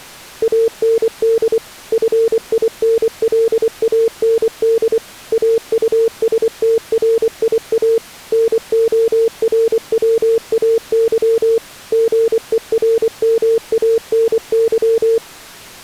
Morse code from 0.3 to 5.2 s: AND FINLAND

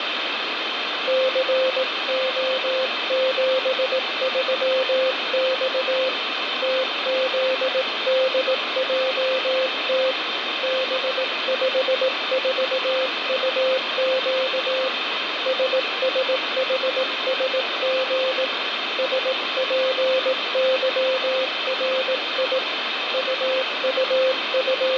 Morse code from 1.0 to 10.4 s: CO73X TZDJT

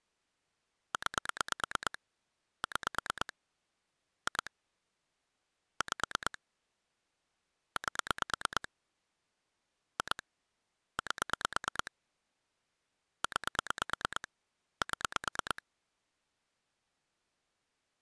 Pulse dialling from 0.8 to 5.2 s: 9 6 2

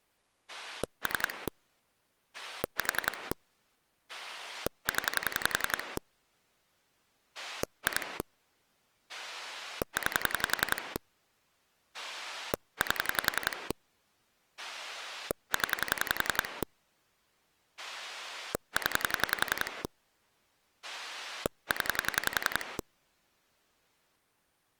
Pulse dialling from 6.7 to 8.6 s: 2

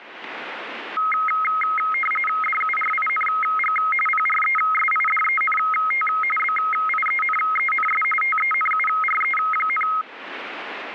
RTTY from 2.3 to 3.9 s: DURING

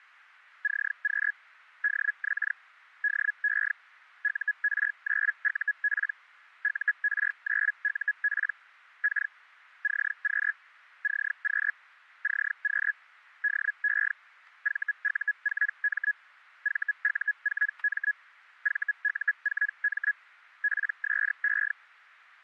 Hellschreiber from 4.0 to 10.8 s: UR9UP UR9UP K CQ

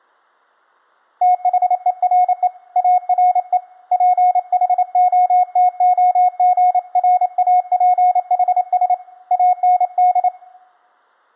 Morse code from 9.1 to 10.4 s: AND

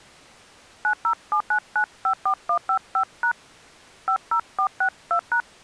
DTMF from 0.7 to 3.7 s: 9079954155#

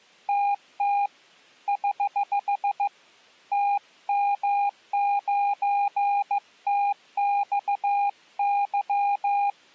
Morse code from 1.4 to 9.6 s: <HH> TM9TXY

